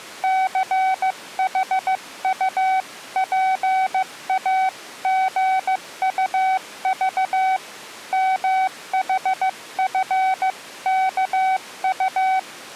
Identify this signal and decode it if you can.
Morse code (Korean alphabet), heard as a keyed tone, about 15 wpm, 760 Hz. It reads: 취조실 문이